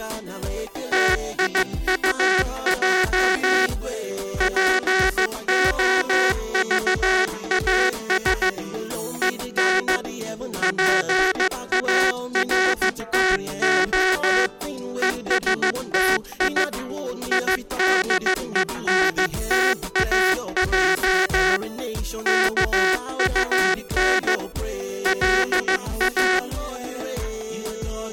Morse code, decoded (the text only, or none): TIUJ POVAS EN PARTO ESTI IDENTAJ KUN LA